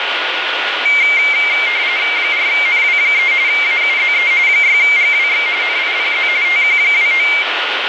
RTTY (45.45 baud, 170 Hz shift), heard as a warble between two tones, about 2200 Hz centre, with radio static and a steady whistle near 1440 Hz. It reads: 4NW3 AUZE 6GWX NIPZ TQ29